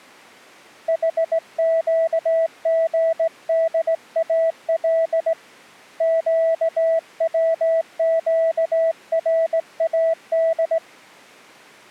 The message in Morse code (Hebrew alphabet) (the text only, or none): חקגדאל קצקראד